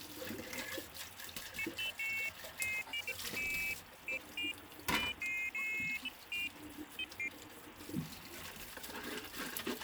Pairs of high tones at irregular times, with kitchen noise. There is no code.